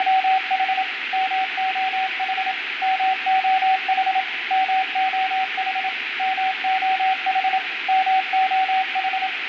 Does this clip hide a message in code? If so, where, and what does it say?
Yes: Morse code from 0.0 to 9.3 s, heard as a keyed tone, machine-sent, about 27 wpm, 760 Hz, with radio static and room echo. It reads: … MOH MOH MOH MOH MOH